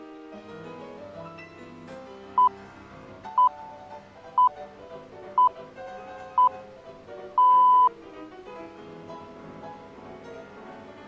Radio time signal (six pips, as the Greenwich Time Signal), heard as pips.